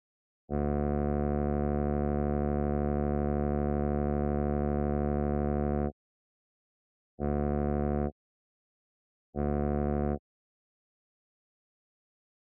Ship horn signal, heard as a ship's horn, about 70 Hz. 1 long, 2 short. At sea: a vessel in fog that is sailing, fishing, towing or hampered.